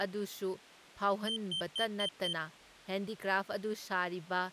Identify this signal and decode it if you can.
Beep code, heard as a piezo beeper, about 3100 Hz, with speech in Manipuri. 5 short. In AMI BIOS tables: processor failure; in Dell tables: CMOS battery failure.